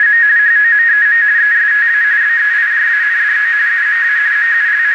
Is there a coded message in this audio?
Yes: RTTY (45.45 baud, 170 Hz shift) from 0.0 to 4.9 s, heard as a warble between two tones, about 1750 Hz centre, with radio static and a narrow filter. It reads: … HOMEM ESTA BEIJANDO UMA …